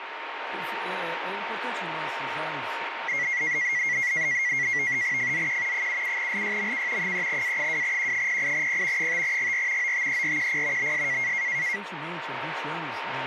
NAVTEX (SITOR-B), 100 baud, 170 Hz shift, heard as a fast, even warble, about 2050 Hz centre, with radio static and a steady whistle near 920 Hz. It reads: FZQ 77LYMK 3A2Q08P 5GR OTERQP BS